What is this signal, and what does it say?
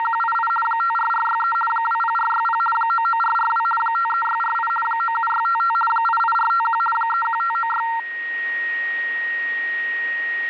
RTTY (50 baud, 450 Hz shift), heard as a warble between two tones, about 1140 Hz centre, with a steady whistle near 1880 Hz. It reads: … 54463 20460 99442 53648 97655 88451 31596